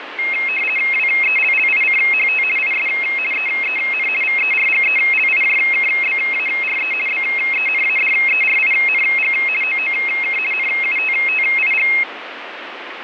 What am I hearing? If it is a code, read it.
RTTY (50 baud, 450 Hz shift), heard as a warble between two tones, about 2350 Hz centre, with radio static. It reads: WELLICHT IS EEN VERGELIJKBARE BENADERING OOK NUTTIG